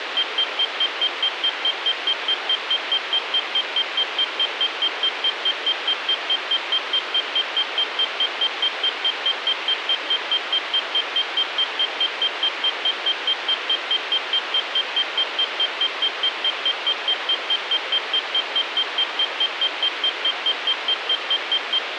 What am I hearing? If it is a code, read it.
Evenly repeated beeps, with radio hiss. There is no code.